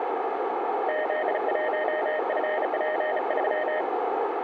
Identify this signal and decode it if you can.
Morse code, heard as a keyed tone, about 35 wpm, 620 Hz, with radio static and a narrow filter. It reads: Z1FP3